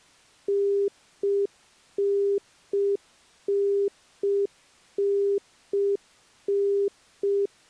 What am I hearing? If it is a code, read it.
Telephone call progress tone (UK plan), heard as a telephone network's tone, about 400 Hz. Congestion tone.